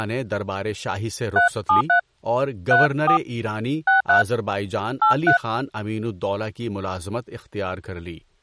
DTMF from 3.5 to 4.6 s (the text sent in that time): 63